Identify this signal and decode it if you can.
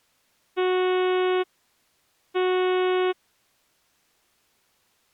Ship horn signal, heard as a ship's horn, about 370 Hz. 2 short. At sea: I am altering course to port.